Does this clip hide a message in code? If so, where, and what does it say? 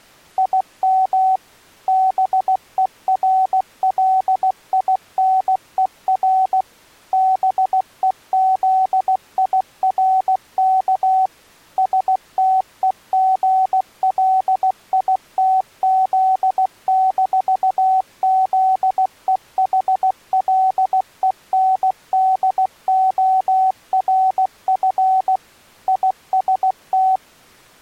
Yes: Morse code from 0.3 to 27.2 s, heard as a keyed tone, machine-sent, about 16 wpm, 760 Hz. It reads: IM BERLINER BEZIRK STEGLITZ-ZEHLENDORF IST